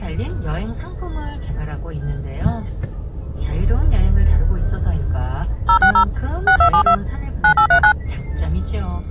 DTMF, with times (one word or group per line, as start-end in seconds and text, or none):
5.7-6.0 060
6.5-6.9 6272
7.4-7.9 9839